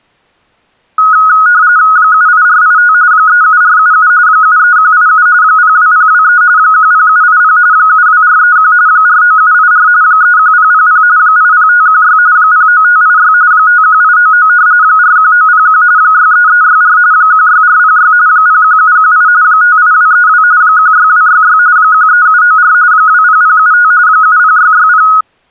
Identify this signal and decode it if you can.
RTTY (45.45 baud, 170 Hz shift), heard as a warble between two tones, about 1360 Hz centre. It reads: 78485 37477 73187 02023 10780 72431 49784 31000 80516 09586 51899 41901 63364 16406 01718 58232 16266 13794 20075 70660